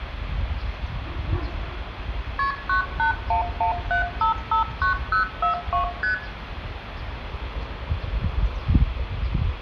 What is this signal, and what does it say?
Multi-frequency trunk signalling (R1, as on North American trunks), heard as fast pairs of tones, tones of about 120 ms, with room echo and the noise of a park. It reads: KP 98117559042 ST